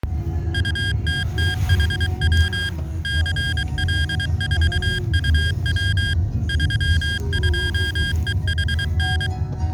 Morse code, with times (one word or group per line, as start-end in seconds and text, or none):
0.5-2.7 UTTHW
3.0-6.1 CL4UW
6.5-9.3 32EHN